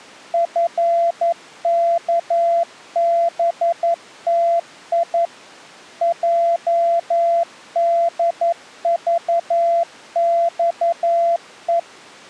Morse code (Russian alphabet), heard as a keyed tone, machine-sent, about 11 wpm, 680 Hz. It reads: ФКБТИ ЙДЖЬЕ